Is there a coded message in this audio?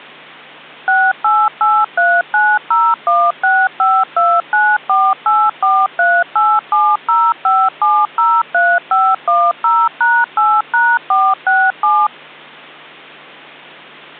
Yes: DTMF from 0.9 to 12.1 s, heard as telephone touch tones, dialled by machine, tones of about 240 ms. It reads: 6883901652948438705703510#8#467